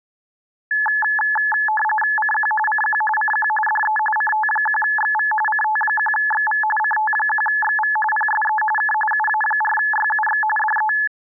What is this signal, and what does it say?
RTTY (45.45 baud, 850 Hz shift), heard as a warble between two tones, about 1290 Hz centre. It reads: CQ CQ CQ DE CT1XV CT1XV CT1XV PSE K UA4YUX DE